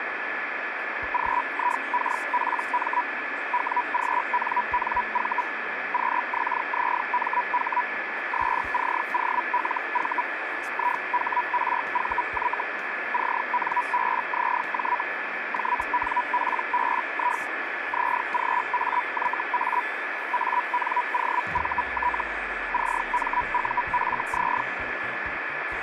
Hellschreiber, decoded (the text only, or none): GIKPM WGNNV QXZMH SCOLV IHRVY CNBZJ JNPBI ZGAYA ANOVT CMUFZ